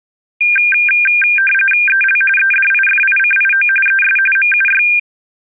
RTTY (45.45 baud, 850 Hz shift), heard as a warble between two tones, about 2000 Hz centre. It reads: EL EDIFICIO ES MUY